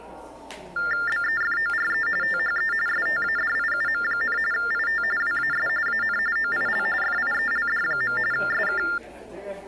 TTY/TDD text telephone tones (45.45 baud Baudot), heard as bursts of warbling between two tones, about 400 Hz shift, 1600 Hz centre, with the noise of a subway station. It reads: BEFORE THE STADIUM, IT WAS AN OIL FIELD. SK